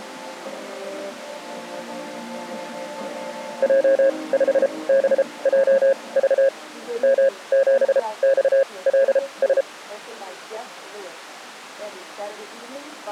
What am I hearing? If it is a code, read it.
Morse code, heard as a keyed tone, machine-sent, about 33 wpm, spaced as for 23 wpm, 540 Hz. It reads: J5BJV M7XLS